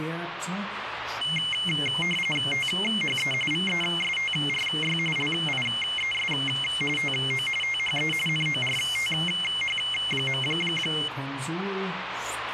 RTTY (45.45 baud, 850 Hz shift), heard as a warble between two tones, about 2550 Hz centre, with radio static. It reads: THE VESTRY LIES TO THE NORTH.